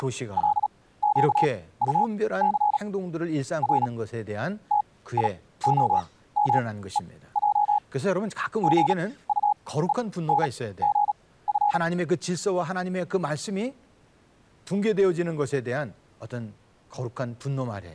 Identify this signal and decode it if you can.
Morse code, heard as a keyed tone, machine-sent, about 37 wpm, spaced as for 18 wpm, 830 Hz, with speech in Korean. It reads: … R TIOMEJ GUENGF